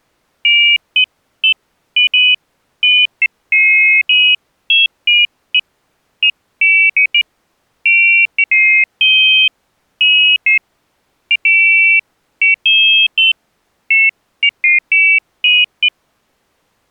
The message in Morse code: none

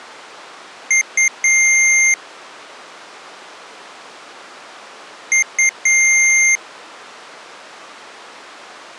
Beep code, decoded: 2 short, 1 long

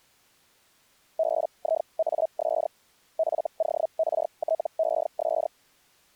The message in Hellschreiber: BIAS FORTES

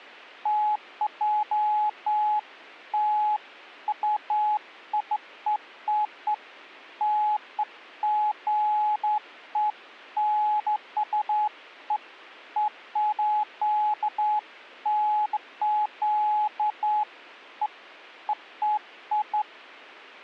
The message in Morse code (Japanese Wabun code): none

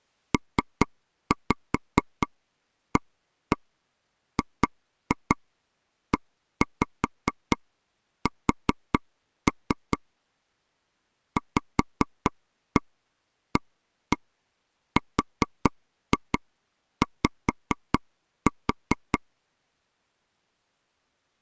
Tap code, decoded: PAGES VARY

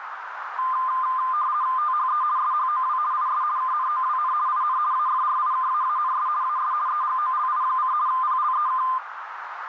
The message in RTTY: THE SHOW IS KNOWN IN AFRIKAANS AS EGOLI: PLEK

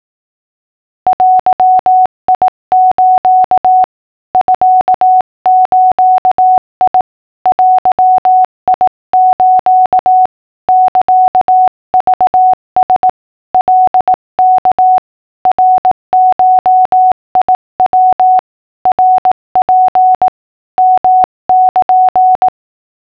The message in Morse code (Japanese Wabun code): デス ミズ デス サクラ カワ ナゴヤ ナツ ヨル

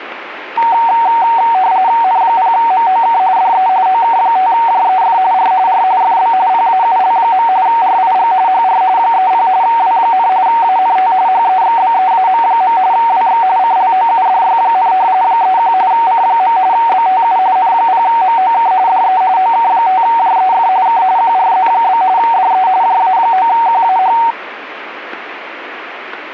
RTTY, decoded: N0MOK DE OK5JEF R R FB PAUL. RIG HR 30 W, ANT HEXBEAM. WX CLOUDY, 31 C. BTU N0MOK DE OK5JEF K QRZ? DE JA9QAH

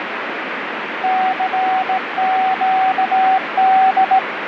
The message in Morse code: CQD

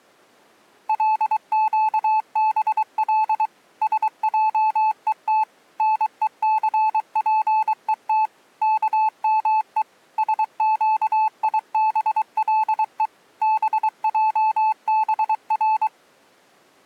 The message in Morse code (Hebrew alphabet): לקבל שעות נוספות כמו שקיבלו בעבר

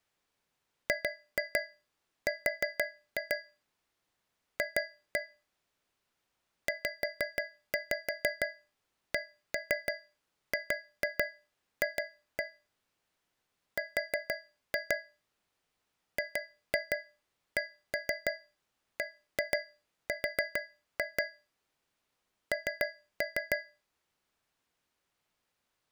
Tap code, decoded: GR F ZCGF R GCBR N

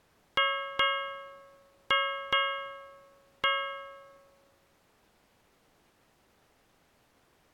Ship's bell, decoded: 5

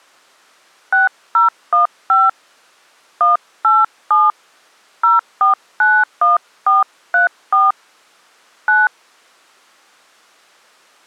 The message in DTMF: 6015 187 0491434 9

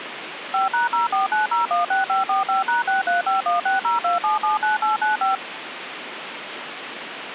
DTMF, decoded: 5#049016545#6351602779895

